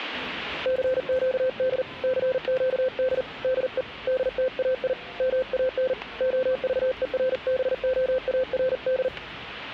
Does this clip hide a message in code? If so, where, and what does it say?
Yes: Morse code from 0.6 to 9.1 s, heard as a keyed tone, hand-sent with a paddle, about 40 wpm, 520 Hz, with static crashes and the noise of a crowd indoors. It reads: CQD CQD DE DTAI MAN OVERBOARD